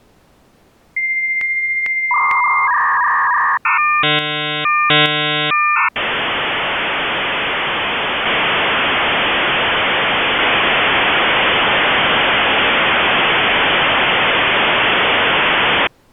Dial-up modem handshake (V.34 or later), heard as a whistle, warbles, then hiss.